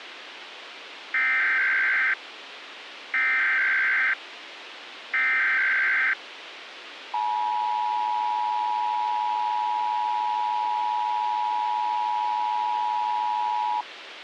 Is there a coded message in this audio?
Yes: Emergency Alert System (SAME) tones (header bursts, then the 853 and 960 Hz attention tone) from 1.1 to 13.8 s, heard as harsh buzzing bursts, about 520.83 baud, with radio hiss.